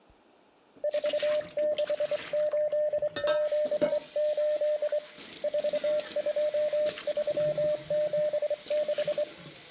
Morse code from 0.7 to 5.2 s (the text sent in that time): 46878